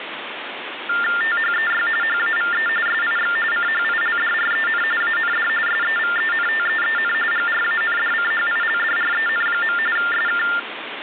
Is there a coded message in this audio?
Yes: TTY/TDD text telephone tones (45.45 baud Baudot) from 0.9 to 10.6 s, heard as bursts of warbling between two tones, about 400 Hz shift, 1600 Hz centre, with phone line noise. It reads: THEY HAVE SIX CHILDREN AND SEVENTEEN GRANDCHILDREN. SK